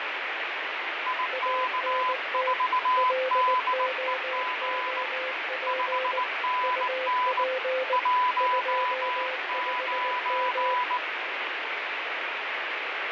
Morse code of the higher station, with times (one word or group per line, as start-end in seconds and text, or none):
1.1-5.0 IK4DEG
5.7-7.4 5NN
7.9-11.0 19